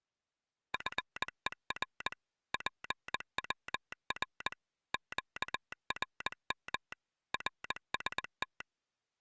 Morse code, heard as a telegraph sounder, machine-sent, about 20 wpm. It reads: FER PWR QRM RST